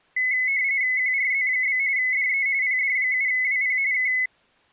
RTTY (45.45 baud, 170 Hz shift), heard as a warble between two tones, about 2100 Hz centre. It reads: QRZ? DE PD7WP K